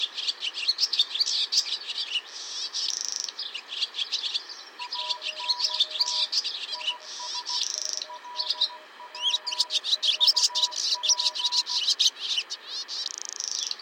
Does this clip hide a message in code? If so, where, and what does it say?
Yes: Morse code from 4.7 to 11.8 s, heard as two keyed tones, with radio static. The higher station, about 16 wpm, 980 Hz: ANT IS LW UP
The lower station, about 25 wpm, 620 Hz: CQ DE VO1FNW